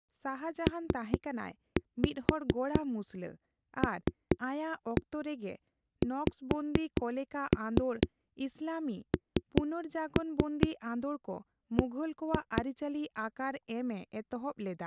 Tap code, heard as knocks on a wall, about 4 knocks a second, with speech in Santali. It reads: PLXNB